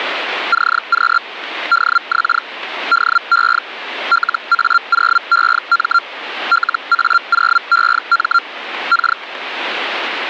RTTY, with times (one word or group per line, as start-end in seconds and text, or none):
none